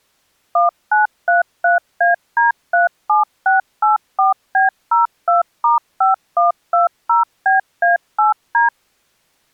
DTMF, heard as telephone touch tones, dialled by machine, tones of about 140 ms. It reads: 1933AD37684B02*5120BA8D